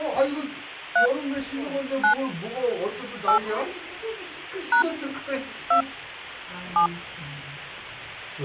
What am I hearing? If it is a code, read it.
DTMF, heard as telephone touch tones, dialled by hand, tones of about 100 ms, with the noise inside a lift. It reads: 3 9 8 # 2 7